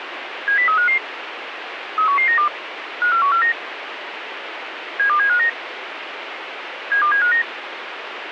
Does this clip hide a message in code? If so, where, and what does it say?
Yes: five-tone selective call (CCIR) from 0.5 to 7.4 s, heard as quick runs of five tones, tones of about 100 ms, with radio hiss and a squelch burst at the end. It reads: 70355 31192 54149 72759 72759